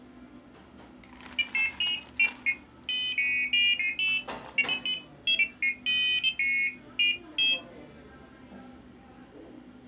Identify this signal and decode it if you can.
Pairs of high tones at irregular times, with the noise of a cafe. There is no code.